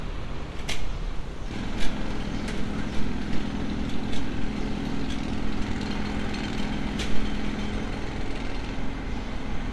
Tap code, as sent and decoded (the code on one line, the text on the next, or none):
none